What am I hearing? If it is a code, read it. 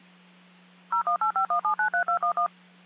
DTMF, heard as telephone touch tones, dialled by machine, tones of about 90 ms, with hum. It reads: 01851793211